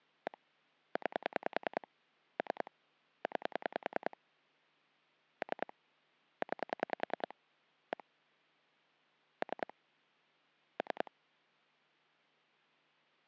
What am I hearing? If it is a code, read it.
Pulse dialling, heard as clicks on a phone line, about 10 pulses a second. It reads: 1 9 3 9 3 9 1 3 3